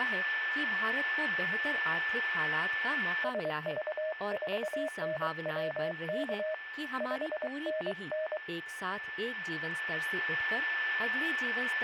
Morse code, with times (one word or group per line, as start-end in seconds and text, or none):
3.2-6.5 SV4NWK
7.0-8.4 5NN